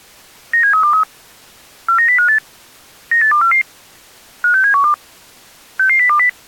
Five-tone selective call (CCIR), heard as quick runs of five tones, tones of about 100 ms. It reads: 97323 49058 98244 56712 66020